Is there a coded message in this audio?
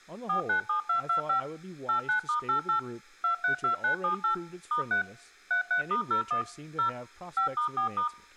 Yes: DTMF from 0.3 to 8.1 s, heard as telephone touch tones, dialled by machine, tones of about 110 ms, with speech in English. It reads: 497225 89*88 232978 *3 33*01 0 5*4*